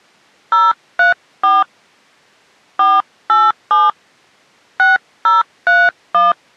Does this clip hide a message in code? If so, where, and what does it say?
Yes: DTMF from 0.5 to 6.3 s, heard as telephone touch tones, dialled by hand, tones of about 180 ms. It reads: 034 487 6031